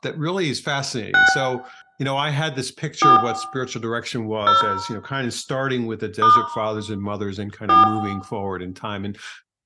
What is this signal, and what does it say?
DTMF, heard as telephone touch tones, dialled by hand, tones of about 140 ms, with room echo and speech in English. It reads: 6 4 0 * 4